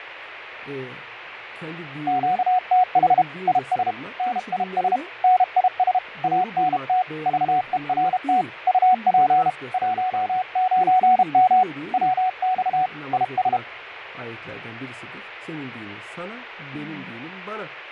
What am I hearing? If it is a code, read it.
Morse code, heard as a keyed tone, hand-sent with a paddle, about 32 wpm, 740 Hz, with radio static and fading. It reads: QTH IS NIS NIS ANT VERT UP 19M WX IS